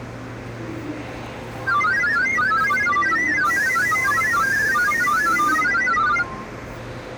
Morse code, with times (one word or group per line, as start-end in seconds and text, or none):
none